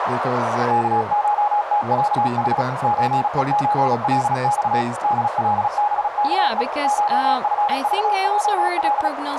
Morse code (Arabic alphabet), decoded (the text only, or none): كشتعح زءزلص دلبكء شفضجل